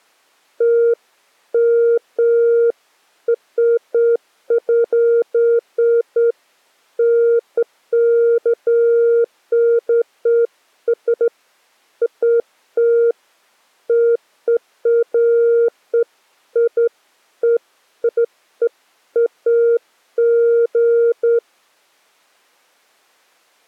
Beeps of irregular length. There is no code.